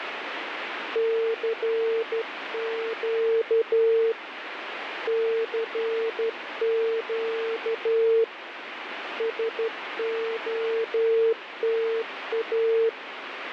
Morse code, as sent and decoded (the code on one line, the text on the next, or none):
-.-. --.- / -.-. --.- / ... --- - .-
CQ CQ SOTA